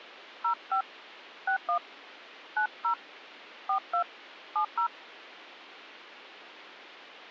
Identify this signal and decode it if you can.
DTMF, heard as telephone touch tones, dialled by hand, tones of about 90 ms. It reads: 05 61 90 42 70